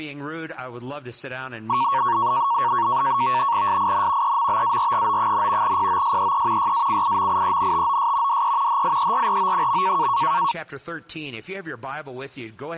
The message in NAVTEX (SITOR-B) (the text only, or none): SIN EMBARGO, POSEE YACIMIENTOS DE HIERRO.